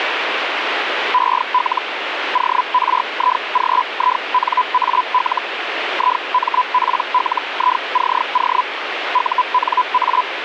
Hellschreiber (Feld-Hell, 122.5 baud), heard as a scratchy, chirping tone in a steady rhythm, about 1000 Hz, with radio static. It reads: EL ORIGINAL IMPLICO UNA